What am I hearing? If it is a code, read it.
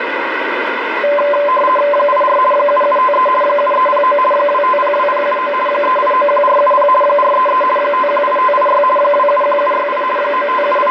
RTTY (50 baud, 450 Hz shift), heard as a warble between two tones, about 800 Hz centre, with radio static. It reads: 84 7753 7309 2502079 3891470 433 518586 271768 …